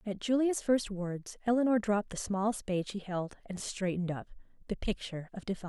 Speech in English. There is no code.